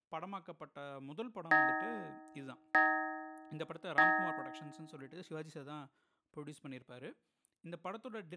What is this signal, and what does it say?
Clock strike, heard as a bell, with speech in Tamil. 3. Three o'clock.